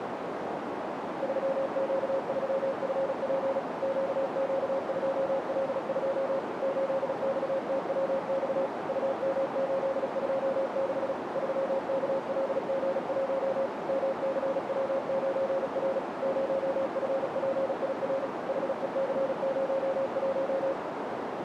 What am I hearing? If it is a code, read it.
Morse code, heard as a keyed tone, machine-sent, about 36 wpm, 540 Hz, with heavy radio static and a narrow filter. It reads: 3Q3FP QQ2L2 8XTWX UM826 3KLG1 MCW9R 0FPIR HEC01